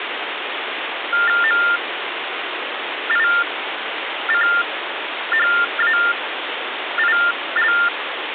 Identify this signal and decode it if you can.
TTY/TDD text telephone tones (45.45 baud Baudot), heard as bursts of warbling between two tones, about 400 Hz shift, 1600 Hz centre, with phone line noise. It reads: MICHAIL